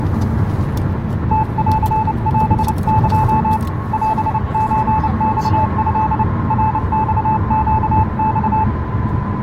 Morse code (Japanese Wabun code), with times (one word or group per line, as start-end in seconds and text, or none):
1.3-3.6 ムンオエ
3.9-6.2 オソマト
6.5-8.6 ナマネマ